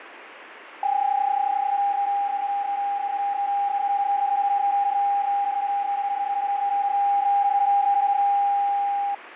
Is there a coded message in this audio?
Yes: PSK31 (31.25 baud) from 0.8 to 9.1 s, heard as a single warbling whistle, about 800 Hz, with radio static.